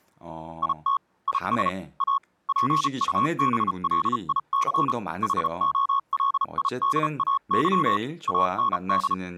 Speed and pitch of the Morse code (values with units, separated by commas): 34 wpm, spaced as for 31 wpm, 1100 Hz